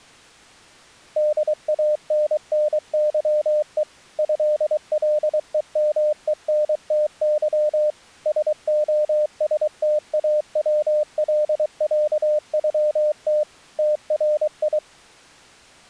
Morse code (Russian alphabet), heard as a keyed tone, machine-sent, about 23 wpm, 600 Hz. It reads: ДАННЫЕ ЭЛЕМЕНТЫ СОСТАВЛЯЮТ ТРИ